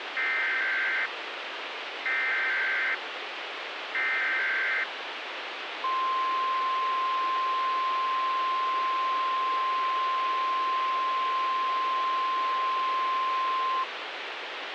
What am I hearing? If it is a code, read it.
Emergency Alert System (SAME) tones (header bursts, then the 1050 Hz attention tone), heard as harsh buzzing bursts, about 520.83 baud, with radio hiss.